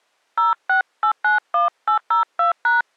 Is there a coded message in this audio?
Yes: DTMF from 0.4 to 2.8 s, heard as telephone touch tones, dialled by hand, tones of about 110 ms. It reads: 06891802#